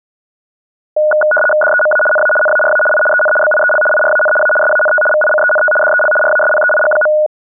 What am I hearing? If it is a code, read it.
RTTY (75 baud, 850 Hz shift), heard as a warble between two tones, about 1040 Hz centre. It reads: DEMA NA NARA I EN BIEL IRAN A SANT VICENT DEL RASPEIG.